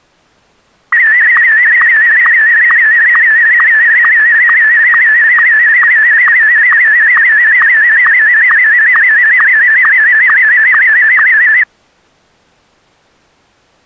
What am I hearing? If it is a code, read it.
SSTV (slow-scan television), Martin M1, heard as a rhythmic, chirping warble.